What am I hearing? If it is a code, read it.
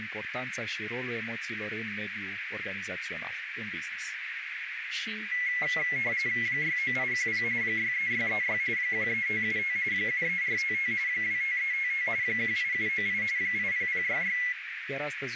RTTY (45.45 baud, 170 Hz shift), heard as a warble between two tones, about 2050 Hz centre, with radio static, a narrow filter and speech in Romanian. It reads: 69810 63636 13575 73455 25355 18798 80066